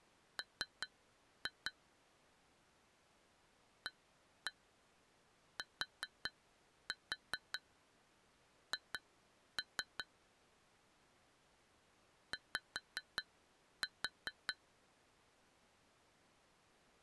Tap code, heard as taps on glass, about 5 knocks a second. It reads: M ATH Y